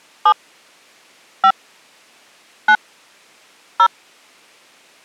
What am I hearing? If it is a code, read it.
DTMF, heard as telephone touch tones, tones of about 70 ms. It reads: 7 5 9 0